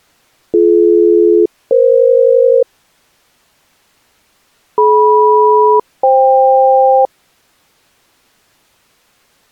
Aircraft SELCAL, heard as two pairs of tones. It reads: BD-EF DM-FK